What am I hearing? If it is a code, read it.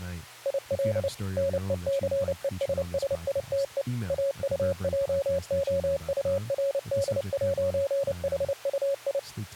Morse code, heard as a keyed tone, machine-sent, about 29 wpm, 550 Hz, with speech in English. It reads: IL NECESSITE AUJOURD'HUI